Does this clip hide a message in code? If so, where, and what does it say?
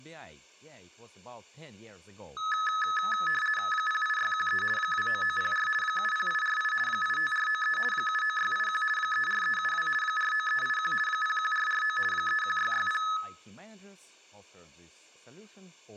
Yes: RTTY (50 baud, 450 Hz shift) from 2.4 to 13.2 s, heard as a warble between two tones, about 1500 Hz centre, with room echo and speech in English. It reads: 08613 29904 70848 85493 79681 34372 49381 01449 31660